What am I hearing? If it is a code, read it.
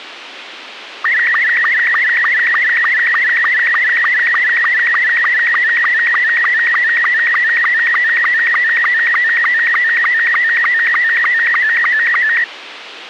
SSTV (slow-scan television), Robot 72, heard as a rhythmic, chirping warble, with radio hiss and a squelch burst at the end.